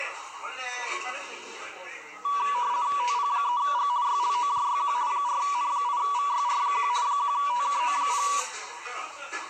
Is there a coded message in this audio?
Yes: RTTY (50 baud, 170 Hz shift) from 2.2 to 8.4 s, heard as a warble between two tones, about 1060 Hz centre, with the noise of a restaurant. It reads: TP3G YLOJYQ 4N8VYR1 1TKO0